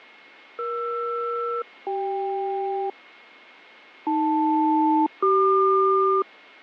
Aircraft SELCAL, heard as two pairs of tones, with radio static, fading and a steady whistle near 2160 Hz. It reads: ER-CK AL-CQ